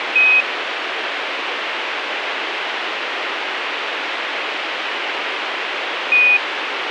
Quindar tones, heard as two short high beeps, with radio hiss.